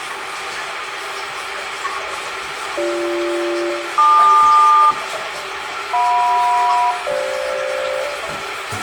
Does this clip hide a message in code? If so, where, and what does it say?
Yes: aircraft SELCAL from 2.8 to 8.0 s, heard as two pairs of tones, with radio hiss, room echo and the noise of a restroom. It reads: BG-LQ JM-FG